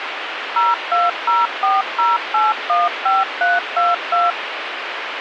DTMF, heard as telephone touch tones, dialled by machine, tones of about 180 ms, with radio hiss. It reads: 02040815322